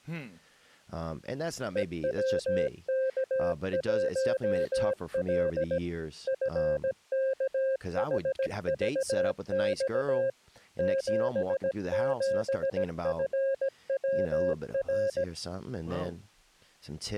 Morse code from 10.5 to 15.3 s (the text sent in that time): 77FWR